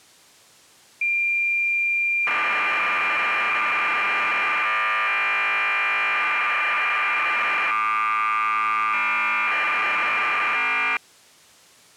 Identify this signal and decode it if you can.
Cassette data (Kansas City type), 1200 baud, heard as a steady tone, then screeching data.